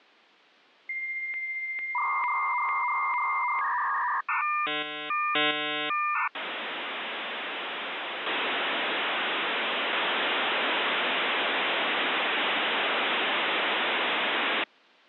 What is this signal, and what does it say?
Dial-up modem handshake (V.34 or later), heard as a whistle, warbles, then hiss.